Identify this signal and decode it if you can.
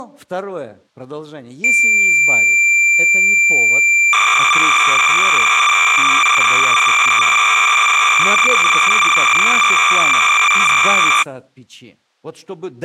Cassette data (Kansas City type), 300 baud, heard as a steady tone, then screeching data, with speech in Russian.